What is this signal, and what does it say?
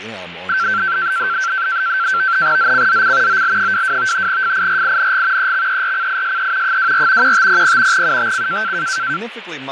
NAVTEX (SITOR-B), 100 baud, 170 Hz shift, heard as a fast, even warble, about 1450 Hz centre, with radio static, fading and speech in English. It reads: ZCZC OL22 FIRING EXERCISE 24 1500 UTC